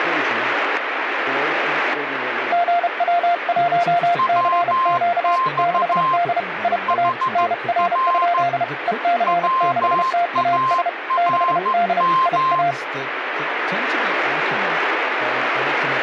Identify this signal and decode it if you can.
Morse code, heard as two keyed tones, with radio static and speech in English. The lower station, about 32 wpm, 700 Hz: GW1CQ 6D IA NR? EC6TAS 6D IA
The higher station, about 14 wpm, 1050 Hz: WX HR WARM